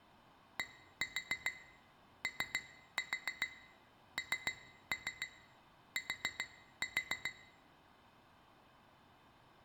Tap code, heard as taps on glass, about 7 knocks a second, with room echo. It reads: DONT